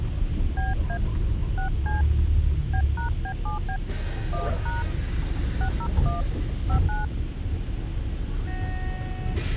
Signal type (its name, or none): DTMF